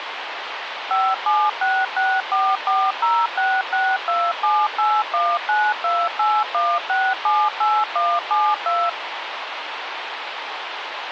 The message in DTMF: 57664406627819281678172

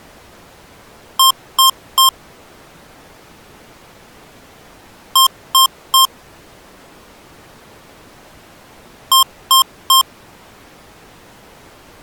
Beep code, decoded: 3 short

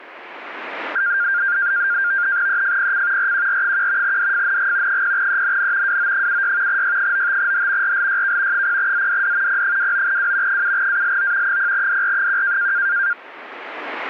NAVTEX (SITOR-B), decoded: EFPC RQR1 DFNG 0ENN WO76 Y95H RLYK 0ZDD P29W 7ALO 0DR1

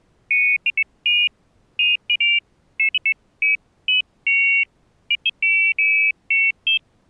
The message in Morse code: none

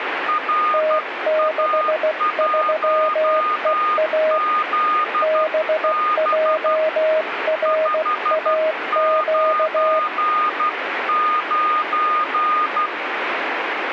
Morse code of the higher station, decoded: RA1ZB 599

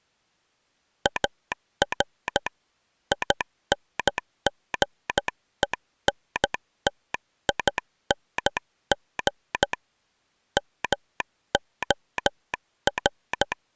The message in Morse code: AR INGENTING MOR

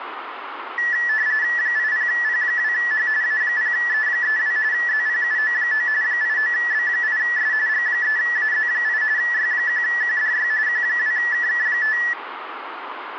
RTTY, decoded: 80P2H A0E32 ZPUO9 89B8S G3AZ8 Y1QDY Q2KK5

